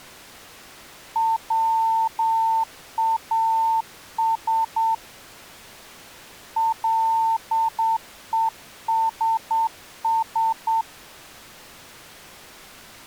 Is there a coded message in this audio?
Yes: Morse code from 1.1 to 10.9 s, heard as a keyed tone, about 8 wpm, 900 Hz. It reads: WAS LESS